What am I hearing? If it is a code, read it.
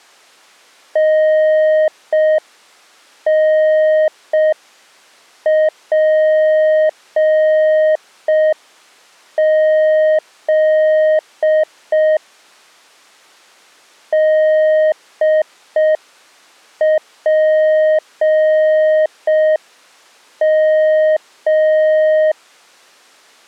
Morse code, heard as a keyed tone, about 5 wpm, 620 Hz. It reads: NNPZ DPM